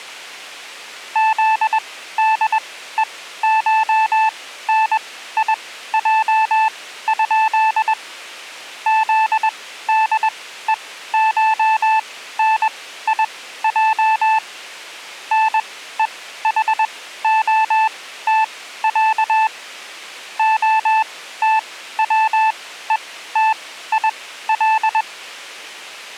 Morse code (Russian alphabet), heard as a keyed tone, machine-sent, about 21 wpm, spaced as for 14 wpm, 880 Hz. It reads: ЗДЕШНИЙ? ЗДЕШНИЙ НЕХОТЯ ОТВЕТИЛ